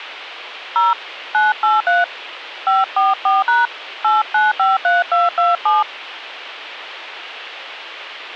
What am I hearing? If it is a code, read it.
DTMF, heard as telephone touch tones, dialled by hand, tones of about 170 ms. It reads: 0 983 544# 8953227